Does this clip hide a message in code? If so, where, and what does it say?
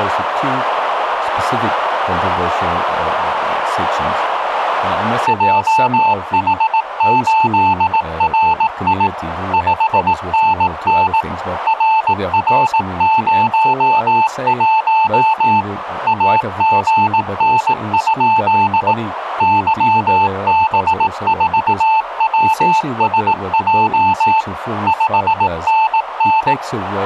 Yes: Morse code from 5.2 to 26.6 s, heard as a keyed tone, machine-sent, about 18 wpm, 880 Hz, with radio static. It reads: JH8RI 5NN RR01 AGN? YB4WSJ 5NN